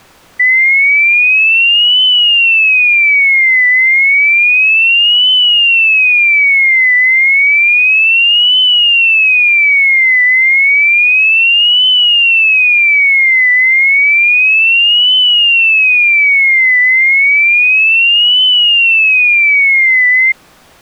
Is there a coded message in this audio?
No, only a tone that sweeps in pitch again and again.